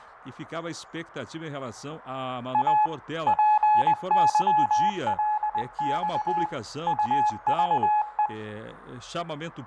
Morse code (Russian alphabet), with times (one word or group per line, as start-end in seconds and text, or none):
2.5-2.9 А
3.3-6.5 ПЫЛЬ
6.9-8.3 УЖЕ